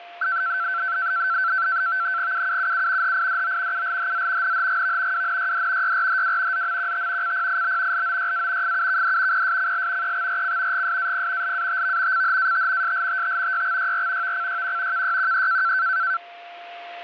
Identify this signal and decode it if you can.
NAVTEX (SITOR-B), 100 baud, 170 Hz shift, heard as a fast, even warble, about 1440 Hz centre, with a steady whistle near 700 Hz. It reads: UUUU HIDO ULHZ NHGV WNYD YRHW ZMQT CPIB LOYA FUKD PSCL EXRC GSAP LATV CHAT SLTT YXYR VCYQ KYQE